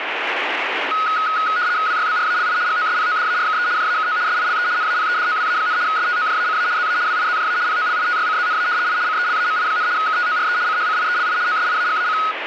RTTY (75 baud, 170 Hz shift), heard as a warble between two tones, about 1360 Hz centre, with radio static. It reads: WYBRALI GOSPODARKE JAKO SILE NAPEDOWA, STOJACA ZA WIZJA POLITYCZNA I CELAMI, KTORE CHCIELI OSIAGAC